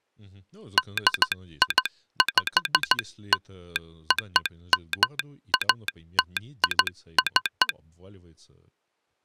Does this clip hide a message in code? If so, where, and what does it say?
Yes: Morse code (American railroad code) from 0.7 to 7.8 s, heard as a telegraph sounder, hand-sent with a straight key, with speech in Russian. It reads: DIPLOMATIC